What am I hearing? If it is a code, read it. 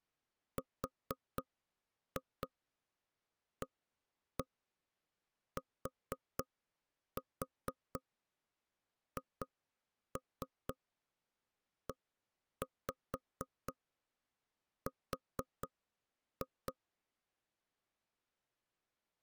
Tap code, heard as knocks on wood, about 4 knocks a second. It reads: RATHER